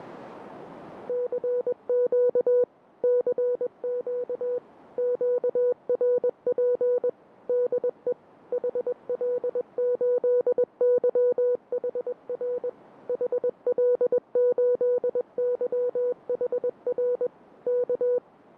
Morse code, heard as a keyed tone, machine-sent, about 21 wpm, 490 Hz. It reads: CQ CQ QRP DE HL8YHR HL8YHR K